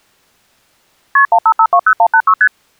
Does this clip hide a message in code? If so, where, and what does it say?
Yes: multi-frequency trunk signalling (R1, as on North American trunks) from 1.2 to 2.5 s, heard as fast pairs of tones, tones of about 70 ms. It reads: KP 15520186 ST